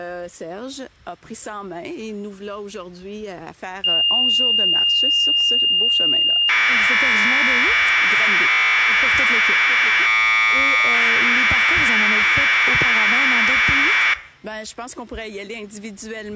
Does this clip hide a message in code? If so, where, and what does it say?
Yes: Commodore tape loading (standard loader) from 3.8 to 14.1 s, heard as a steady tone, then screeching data.